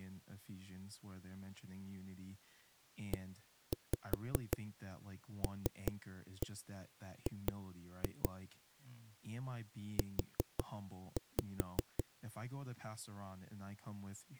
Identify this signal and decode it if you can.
Tap code, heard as knocks on a wall, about 5 knocks a second, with speech in English. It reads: ELG U